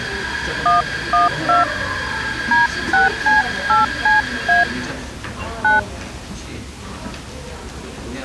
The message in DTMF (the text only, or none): 112 D6C8CA 9